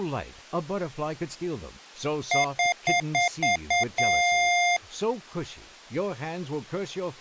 Beep code, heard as beeps from a small speaker, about 700 Hz, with speech in English. 6 short, 1 long.